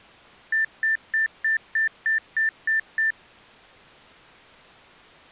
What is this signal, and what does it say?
Beep code, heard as beeps from a small speaker, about 1800 Hz. 9 short. In AMI BIOS tables: ROM checksum failure.